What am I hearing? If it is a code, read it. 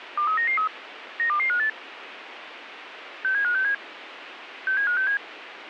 Five-tone selective call (CCIR), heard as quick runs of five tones, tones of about 100 ms, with radio hiss. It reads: 23993 92258 67567 67567